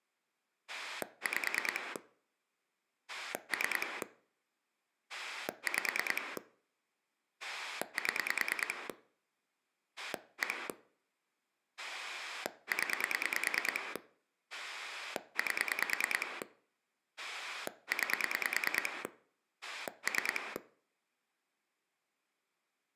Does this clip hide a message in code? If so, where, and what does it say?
Yes: pulse dialling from 0.7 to 20.6 s, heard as a rotary dial, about 9 pulses a second. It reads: 5 3 5 7 1 0 8 9 3